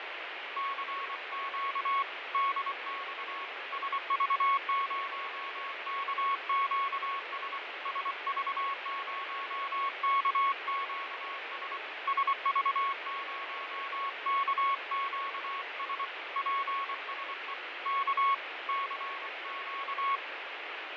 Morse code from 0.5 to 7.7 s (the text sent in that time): CQ DX SV0KQS